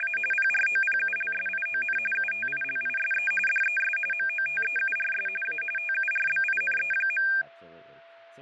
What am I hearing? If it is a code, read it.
RTTY (45.45 baud, 850 Hz shift), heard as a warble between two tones, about 2000 Hz centre, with fading, a steady whistle near 670 Hz and speech in English. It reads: … PROPULSION UTILISE DES MOTEURS A TURBINE.